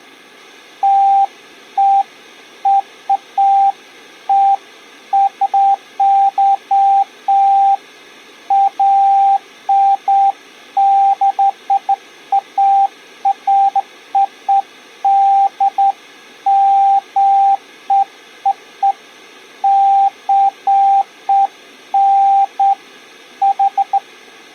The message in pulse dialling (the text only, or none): none